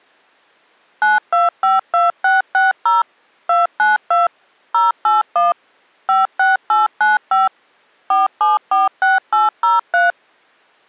DTMF, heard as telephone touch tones, dialled by machine, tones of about 160 ms. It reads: 9252660 292 081 56895 4746803